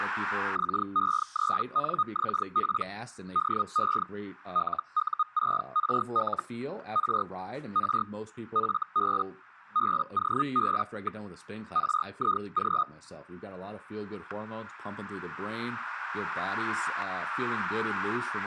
Hellschreiber (Feld-Hell, 122.5 baud), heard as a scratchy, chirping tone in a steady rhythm, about 1240 Hz, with static crashes and speech in English. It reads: XE3NXP DE LU6RL R R FB BOB. RIG